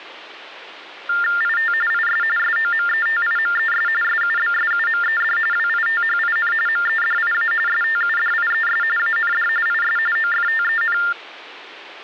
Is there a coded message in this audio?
Yes: TTY/TDD text telephone tones (45.45 baud Baudot) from 1.1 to 11.1 s, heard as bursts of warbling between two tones, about 400 Hz shift, 1600 Hz centre. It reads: IT IS SOMETIMES SUBSUMED WITHIN MEDIA STUDIES AND IS OFTEN